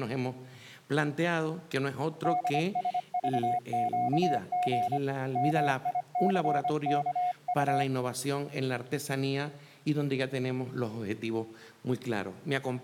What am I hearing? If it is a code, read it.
Morse code, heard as a keyed tone, hand-sent with a paddle, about 25 wpm, 720 Hz. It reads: DSVQG MICKU